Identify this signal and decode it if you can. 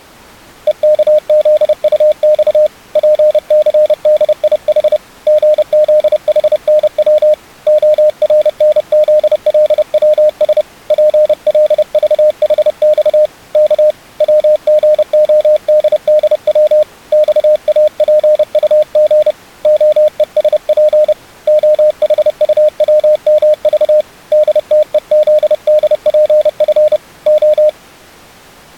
Morse code, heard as a keyed tone, hand-sent with a paddle, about 30 wpm, 610 Hz. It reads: EKZUX PCDIH GZHNW ORNZLWS PLVHX K WGODDW XAPUG OESP OHUWMV DTEZDPF O